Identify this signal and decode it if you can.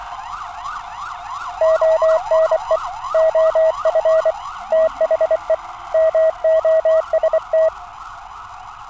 Morse code, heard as a keyed tone, hand-sent with a paddle, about 24 wpm, 640 Hz, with street noise. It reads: ONE OF THE MOST